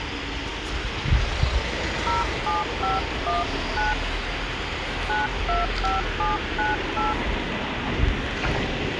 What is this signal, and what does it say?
DTMF, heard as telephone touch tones, dialled by hand, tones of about 170 ms, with phone line noise and the noise of a residential street. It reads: 07519 925798